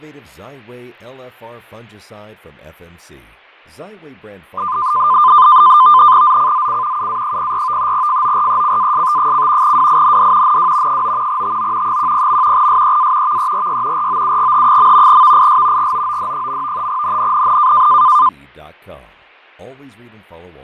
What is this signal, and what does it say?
NAVTEX (SITOR-B), 100 baud, 170 Hz shift, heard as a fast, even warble, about 1110 Hz centre, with fading and speech in English. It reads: ZCZC UA04 FORECAST: WIND NW 9 TO 10. SEA VERY ROUGH. VIS GOOD. NNNN